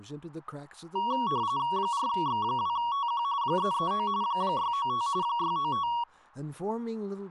RTTY (45.45 baud, 170 Hz shift), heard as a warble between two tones, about 1030 Hz centre, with speech in English. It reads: 4X2TQ 339 695 695